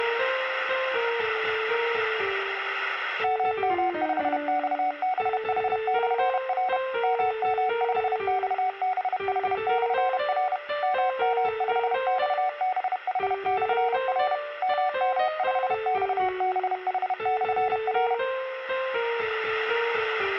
Morse code, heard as a keyed tone, machine-sent, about 31 wpm, 740 Hz. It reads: MM5XBH/R MM5XBH/R MM5XBH/R MM5XBH/R